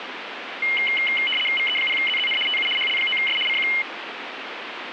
RTTY (75 baud, 850 Hz shift), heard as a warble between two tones, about 2550 Hz centre, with radio static. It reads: VE0ZZN TU HL9S CQ